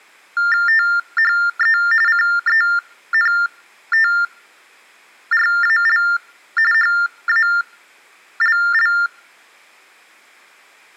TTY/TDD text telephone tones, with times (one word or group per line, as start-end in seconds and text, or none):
0.7-1.8 THE
2.1-6.0 CENTRAL
6.7-8.9 HALL